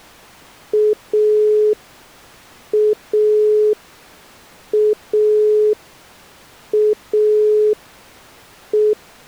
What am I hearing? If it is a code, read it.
Telephone call progress tone (pulsed, as in Italy), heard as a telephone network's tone, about 420 Hz. Dial tone.